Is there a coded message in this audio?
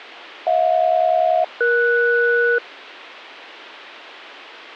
Yes: aircraft SELCAL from 0.5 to 2.6 s, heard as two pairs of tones, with a squelch burst at the end. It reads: HJ-ES